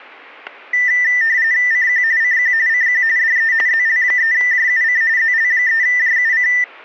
RTTY (45.45 baud, 170 Hz shift), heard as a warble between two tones, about 1900 Hz centre, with static crashes. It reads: CQ CQ CQ DE ZL3JUC ZL3JUC